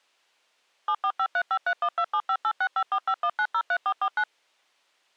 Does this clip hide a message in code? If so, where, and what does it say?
Yes: DTMF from 0.9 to 4.2 s, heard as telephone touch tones, dialled by machine, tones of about 70 ms. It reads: 7453531275865451903449